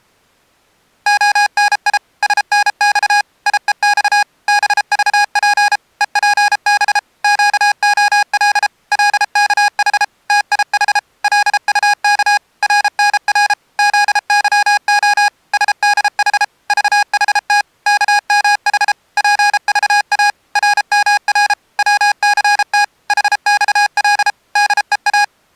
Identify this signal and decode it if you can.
Morse code, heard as electronic beeps, machine-sent, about 33 wpm, 820 Hz. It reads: ONI SNX IEX BVP EPB QOL LKH TIH LUK RNR ZYO SDH VHT KMH PVA RMR WCT HXL DEA